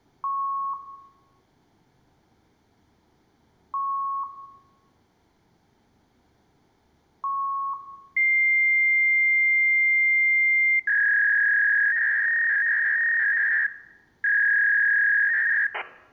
Fax machine handshake, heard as beeps, a long tone and a warble, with room echo.